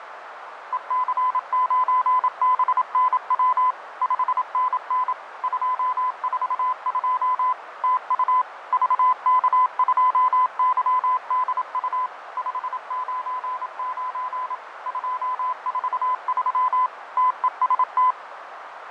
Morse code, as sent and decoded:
. -.-. ----. -... -. .-- / ..... -. -. / ..--- ....- ..--- / - ..- / ...- -.- ..--- -.-- -.. ..- / ..... ----. ----. / ..--- ....- ...-- / - . ... -
EC9BNW 5NN 242 TU VK2YDU 599 243 TEST

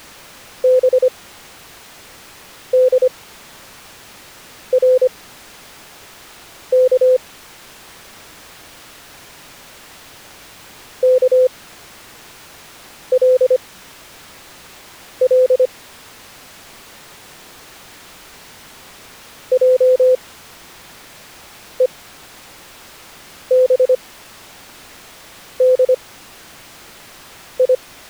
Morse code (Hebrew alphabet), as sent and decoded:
-... -.. .-. -.- / -.- .-.. .-.. / .--- . -... -.. ..
בדרך כלל עובדי

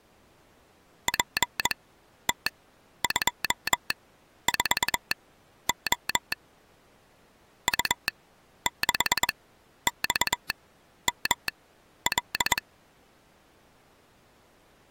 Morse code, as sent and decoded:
.--. - ..--- ....- --- / ..- -.... -..- -- .-..
PT24O U6XML

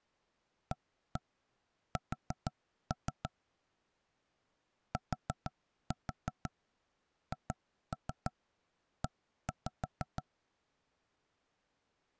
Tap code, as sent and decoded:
1-1 4-3 / 4-4 2-3 1-5
AS THE

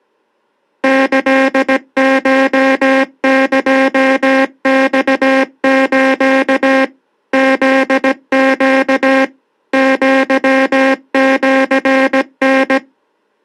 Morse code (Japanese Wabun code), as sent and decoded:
-.-.. ---- -.--- -..- ---.- / --.. --.- / --.-- --.-. -.
キコエマス フネ アシタ

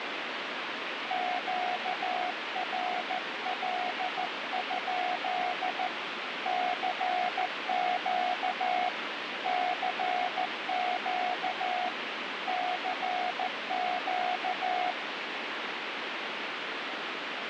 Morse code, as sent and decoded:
--.- .-. .-.. ..--.. / -.-. --.- / -.-. --.- / -.-. --.-
QRL? CQ CQ CQ

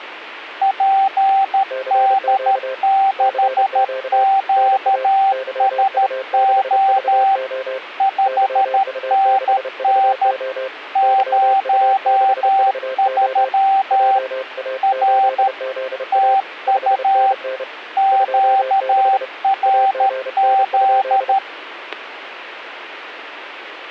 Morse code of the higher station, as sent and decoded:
.--. -.. -.... --.- ... --- / ..... -. -. / ----- ...-- / .-. / - ..- / --.- .-. --..
PD6QSO 5NN 03 R TU QRZ

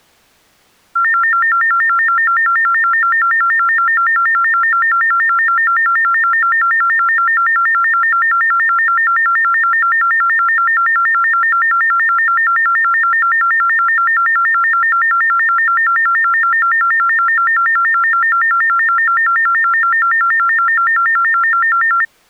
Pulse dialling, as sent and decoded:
none

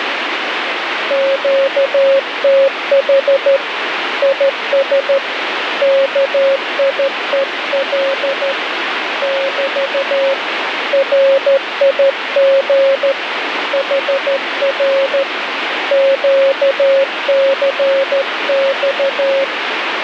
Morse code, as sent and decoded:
--.- - .... / .. ... / -.- .. . .-.. / -...- / .-. .. --. / .... .-. / --.- -.-. -..-
QTH IS KIEL <BT> RIG HR QCX

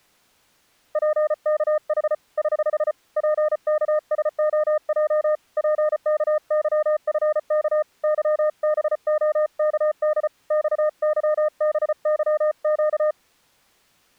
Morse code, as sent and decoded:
.--. -.- .... / ........ / .--. -.- ... --- .--- / .--. -.- -.-- ..-. -.- / -.-- -... --- -.- -.. / -..- -.-- -... -.-- --.-
PKH <HH> PKSOJ PKYFK YBOKD XYBYQ

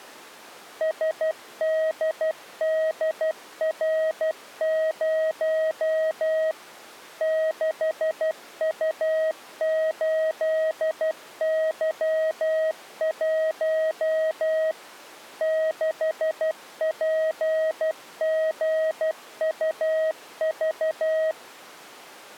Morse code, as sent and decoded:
... -.. -.. .-. ----- / -.... ..- ---.. -.-- .---- / -.... .--. --. ..- ...-
SDDR0 6U8Y1 6PGUV

